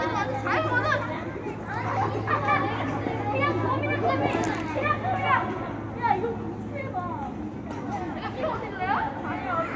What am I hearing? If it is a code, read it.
The noise of a residential street. There is no code.